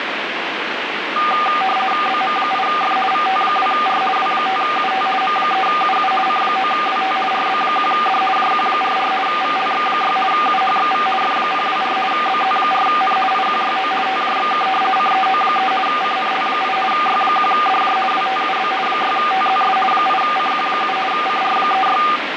RTTY (50 baud, 450 Hz shift), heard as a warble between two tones, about 990 Hz centre, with radio static. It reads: BM8F VT2R W5UT M3UU C9WT RB1D JQ44 VLX6 UHXV F024 BZ4N IQYO TJXK CEO3 CNL8 Y1DJ WTUB 6TZS 8CQ7 CR36